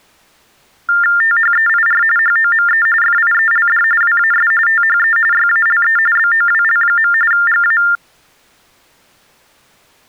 TTY/TDD text telephone tones (45.45 baud Baudot), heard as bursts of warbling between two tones, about 400 Hz shift, 1600 Hz centre. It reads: THEIR HOME FIELD WAS THE YALE BOWL. GA